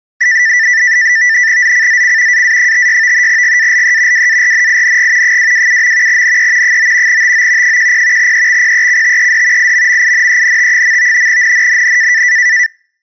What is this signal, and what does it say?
NAVTEX (SITOR-B), 100 baud, 170 Hz shift, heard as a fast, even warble, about 1900 Hz centre. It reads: ZCZC AA56 GALE WARNING 227. NE 9 TO 10 EXPECTED IMMINENT. NNNN